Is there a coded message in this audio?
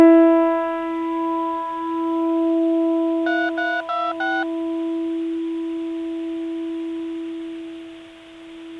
Yes: DTMF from 3.3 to 4.4 s, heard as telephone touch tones, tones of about 230 ms. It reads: 3326